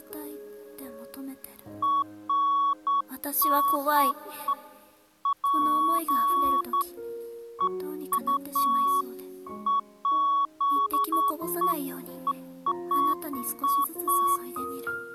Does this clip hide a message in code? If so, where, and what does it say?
No, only beeps of irregular length.